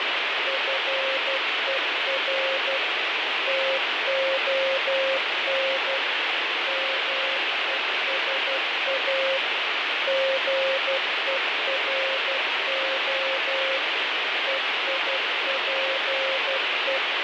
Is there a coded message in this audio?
Yes: Morse code (Greek alphabet) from 0.4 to 17.0 s, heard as a keyed tone, machine-sent, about 12 wpm, 540 Hz, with heavy radio static and fading. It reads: ΦΕΡ ΤΟΝ ΜΕΣΑ ΓΕΡΟ ΕΙΠΕ